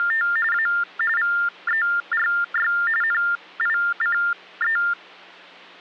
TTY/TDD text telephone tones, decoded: … A VERY NICE

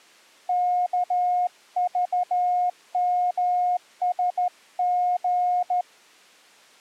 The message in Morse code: KVMSG

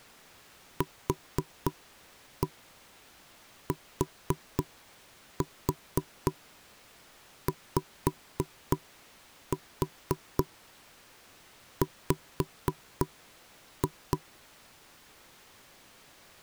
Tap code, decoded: QTYW

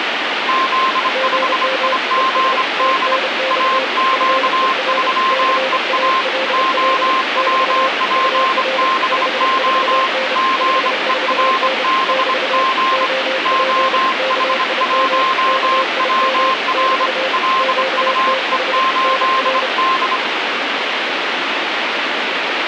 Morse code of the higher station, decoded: Z5IGD AQ3EA OWPBO GERBG OH1WR LUE8D

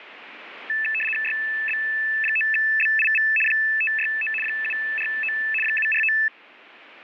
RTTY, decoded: YB9BIV 569 749 749

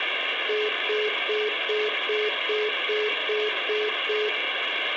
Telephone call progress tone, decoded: congestion tone

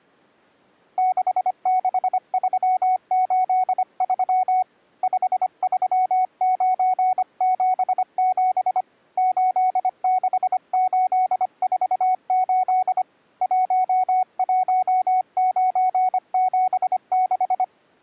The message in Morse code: 66383 53977 86848 11976

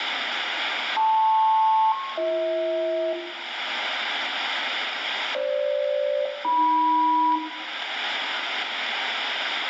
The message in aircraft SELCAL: LP-BH FG-AM

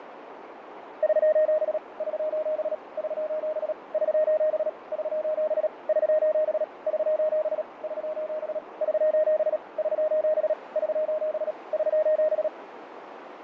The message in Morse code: <SOS> <SOS> <SOS> <SOS> <SOS> <SOS> <SOS> <SOS> <SOS> <SOS> <SOS> <SOS>

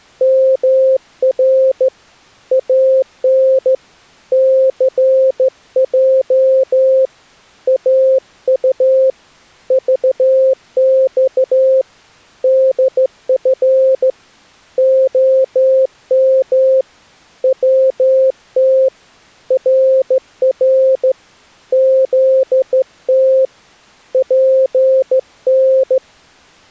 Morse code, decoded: MR AN CJ AU VX DF OM WT RR ZT PN

